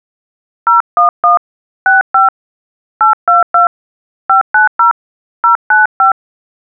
DTMF, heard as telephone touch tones, dialled by hand, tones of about 140 ms. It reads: 011 65 822 590 095